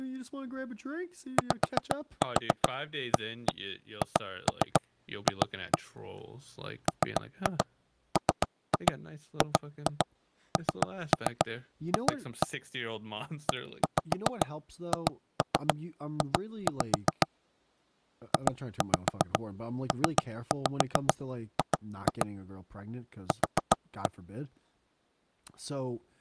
Tap code, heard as knocks on wood, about 7 knocks a second, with speech in English. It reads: YAHF MMGNF EHJ JPG Q